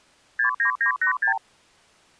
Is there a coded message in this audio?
Yes: multi-frequency trunk signalling (R2, with the far end's replies) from 0.4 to 1.4 s, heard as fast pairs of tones, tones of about 100 ms. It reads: 69986